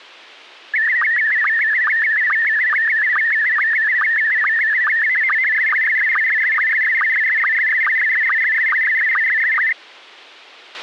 SSTV (slow-scan television), Scottie S1, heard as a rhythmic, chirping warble, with a squelch burst at the end.